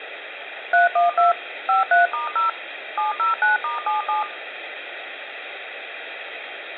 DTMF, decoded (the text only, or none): 312 53*0 709*77